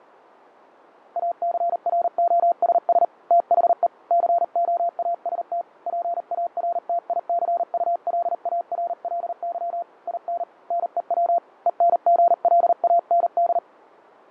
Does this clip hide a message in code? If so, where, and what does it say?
Yes: Morse code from 1.1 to 13.6 s, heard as a keyed tone, hand-sent with a paddle, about 39 wpm, 690 Hz, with fading. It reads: ACROSS THE COAST PARTICULARLY IN NEW ENGLAND